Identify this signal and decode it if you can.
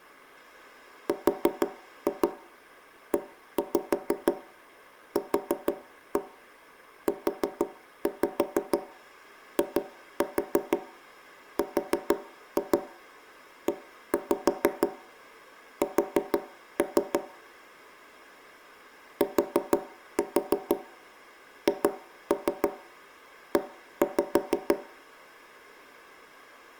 Tap code, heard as knocks on wood, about 6 knocks a second, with room echo. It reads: REQUIRES THE